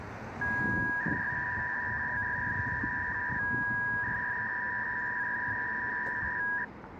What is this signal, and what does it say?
300-baud modem data (V.21 tones), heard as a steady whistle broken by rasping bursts, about 300 baud, 200 Hz shift, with street noise.